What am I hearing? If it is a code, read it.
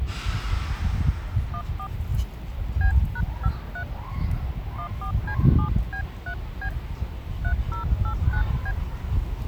DTMF, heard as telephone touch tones, dialled by hand, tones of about 80 ms, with the noise of a residential street. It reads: 14 B#53 14C7B3B 3089B